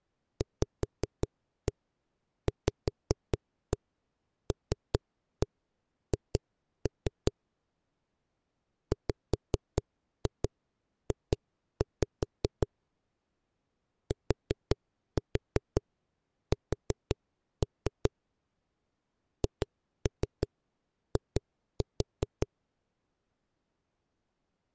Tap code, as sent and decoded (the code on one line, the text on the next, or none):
5-1 5-1 3-1 2-3 / 5-2 2-5 / 4-4 4-3 / 2-3 2-4
VVLH WJ TS HI